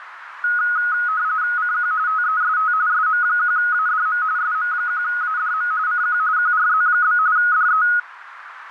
RTTY (45.45 baud, 170 Hz shift), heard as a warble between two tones, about 1360 Hz centre, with radio static and a narrow filter. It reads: CQ TEST SM1ADM SM1ADM CQ QRZ? DE